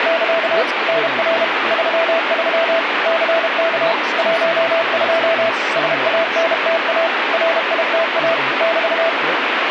Morse code, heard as a keyed tone, machine-sent, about 32 wpm, 660 Hz, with radio static and speech in English. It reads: <KA> NR 33 CK 12 SANTA RITA <BT>